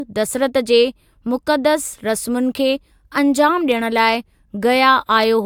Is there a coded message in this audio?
No, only speech in Sindhi.